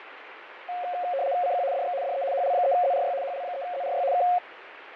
RTTY (75 baud, 170 Hz shift), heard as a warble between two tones, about 630 Hz centre, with radio static and fading. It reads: CQ DX DE HL3ZRY HL3ZRY K